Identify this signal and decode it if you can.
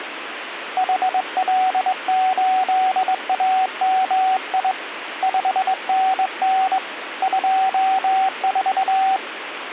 Morse code, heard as a keyed tone, hand-sent with a straight key, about 21 wpm, 760 Hz, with radio static. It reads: HL8AMI 5NN 24